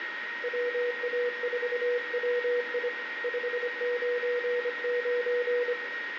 Morse code, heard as a keyed tone, hand-sent with a paddle, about 25 wpm, 490 Hz, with radio static, a steady whistle near 1870 Hz and room echo. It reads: WA4WI 599